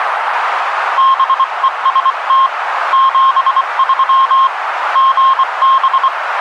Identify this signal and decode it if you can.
Morse code, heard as a keyed tone, hand-sent with a paddle, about 24 wpm, 1070 Hz, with radio static and a narrow filter. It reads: BEST 73 GB